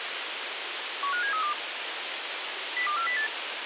Five-tone selective call (CCIR), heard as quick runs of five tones, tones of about 100 ms, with radio hiss. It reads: 15732 02408